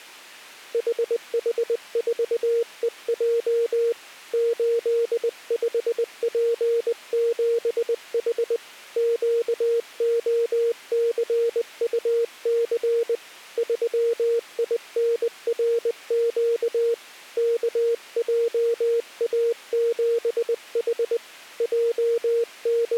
Morse code, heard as a keyed tone, hand-sent with a paddle, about 20 wpm, 470 Hz. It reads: HH4EJ 85P7H QOCUC 3INRQ KJA7H …